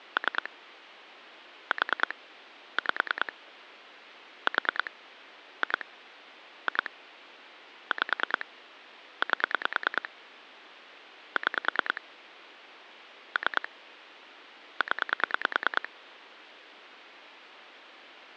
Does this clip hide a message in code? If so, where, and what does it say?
Yes: pulse dialling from 0.2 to 15.9 s, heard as clicks on a phone line, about 9 pulses a second. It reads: 3 4 5 4 2 2 5 8 6 3 0